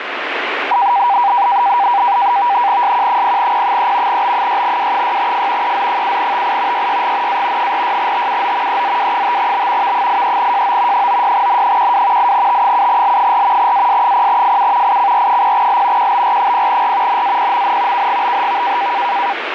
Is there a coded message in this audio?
Yes: NAVTEX (SITOR-B), 100 baud, 170 Hz shift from 0.7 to 19.3 s, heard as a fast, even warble, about 880 Hz centre, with radio static. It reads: SQ0P3 B6W6F EZ7TI YYGNA 46TUO EZW5B V83JO 96N12 8T7L4 AS0FU ICR0L QBR0R NAPMN KGBHV